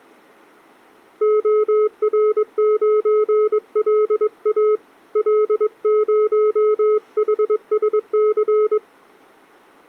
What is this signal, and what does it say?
Morse code, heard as a keyed tone, hand-sent with a paddle, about 22 wpm, 430 Hz. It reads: OR9LA L0HSC